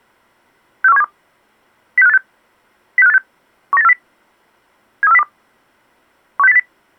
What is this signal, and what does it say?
Five-tone selective call (EEA), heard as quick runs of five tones, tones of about 40 ms. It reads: 64172 06586 06586 19840 73402 16080